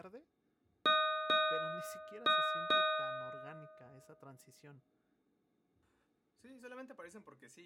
Ship's bell, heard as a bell, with speech in Spanish. 4. Four half-hours of the watch have passed.